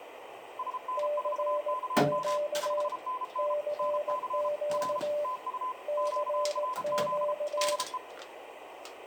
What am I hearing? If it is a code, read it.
Morse code, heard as two keyed tones, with radio static, room echo and kitchen noise. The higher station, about 33 wpm, 1020 Hz: SN4KM 5NN NC R TU QRZ DE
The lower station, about 18 wpm, 590 Hz: CQ CQ CQ